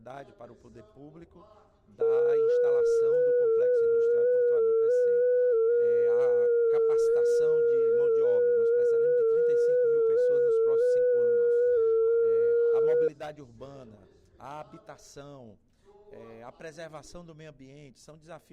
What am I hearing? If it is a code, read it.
FT8 (one signal), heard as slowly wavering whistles, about 6.25 baud.